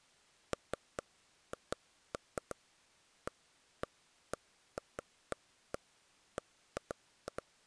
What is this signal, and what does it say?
Irregular taps on a table. There is no code.